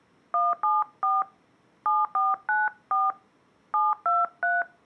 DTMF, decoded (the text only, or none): 174 7494 723